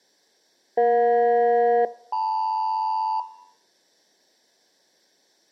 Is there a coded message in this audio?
Yes: aircraft SELCAL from 0.8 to 3.2 s, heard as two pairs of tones. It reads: EJ-LM